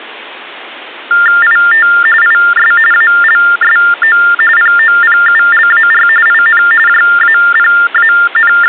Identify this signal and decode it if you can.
TTY/TDD text telephone tones (45.45 baud Baudot), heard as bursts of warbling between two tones, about 400 Hz shift, 1600 Hz centre. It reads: IT IS ALSO POPULAR IN …